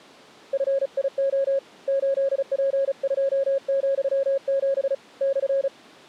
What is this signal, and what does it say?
Morse code, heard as a keyed tone, hand-sent with a paddle, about 35 wpm, 550 Hz. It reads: FIO 8P2,7 /